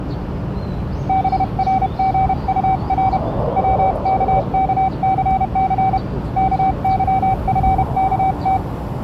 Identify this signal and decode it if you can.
Morse code, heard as a keyed tone, hand-sent with a paddle, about 31 wpm, 760 Hz, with the noise of a park. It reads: BRGUR WKKCC KYFKT